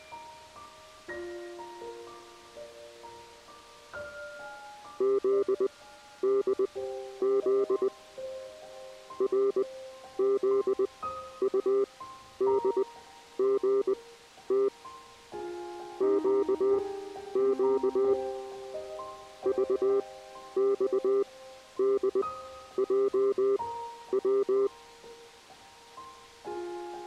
Morse code, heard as a keyed tone, machine-sent, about 20 wpm, spaced as for 11 wpm, 400 Hz. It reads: ZDZ RZUDGT QQ VXDJW